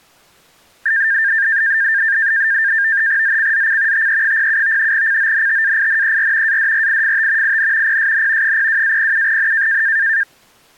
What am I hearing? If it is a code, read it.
NAVTEX (SITOR-B), 100 baud, 170 Hz shift, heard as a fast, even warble, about 1700 Hz centre. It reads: ZCZC TE07 CONTAINER ADRIFT IN PSN 02-07N